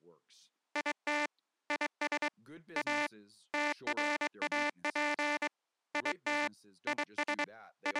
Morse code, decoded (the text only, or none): IT IS A TRAP IT IS …